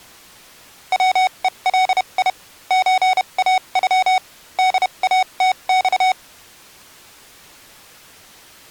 Morse code (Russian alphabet), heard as electronic beeps, machine-sent, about 31 wpm, spaced as for 26 wpm, 750 Hz. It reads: ВЕЛИ ЧАЮ ДАТЬ